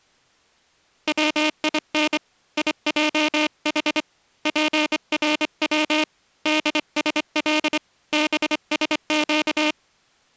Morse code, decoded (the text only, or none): WIN IJH PRW DSL BSQ